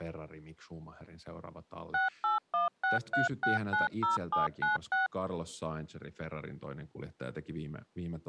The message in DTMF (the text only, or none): 68163690796